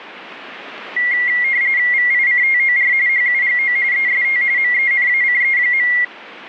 RTTY (45.45 baud, 170 Hz shift), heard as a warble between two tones, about 2050 Hz centre, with radio static. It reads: VICTOR HUGO EST MENACE.